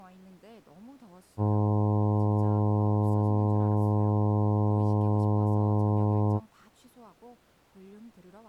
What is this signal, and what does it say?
Ship horn signal, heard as a ship's horn, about 100 Hz, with speech in Korean. 1 long. At sea: a vessel nearing a blind bend, or under power and making way in fog.